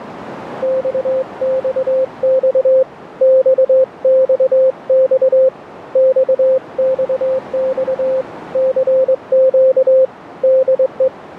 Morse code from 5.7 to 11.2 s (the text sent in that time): XXX CQ DE